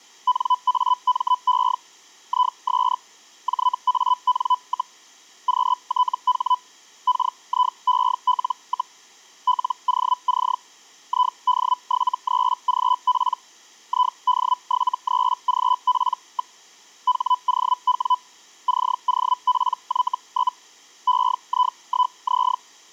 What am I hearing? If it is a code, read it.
Hellschreiber (Feld-Hell, 122.5 baud), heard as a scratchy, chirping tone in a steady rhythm, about 1000 Hz. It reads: NAME IS JAN, QTH KIEL, LOC ID73GP ID73GP. HOW COPY? EI1Z